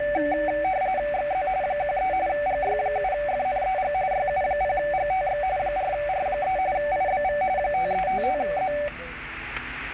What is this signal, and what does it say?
RTTY (45.45 baud, 170 Hz shift), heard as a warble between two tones, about 670 Hz centre, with static crashes and the noise inside a car. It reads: XZ 13 GY7FNEG YU0GTX 4R3 IBV 5355Z